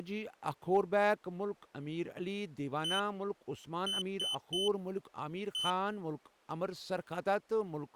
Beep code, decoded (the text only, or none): 1-3-1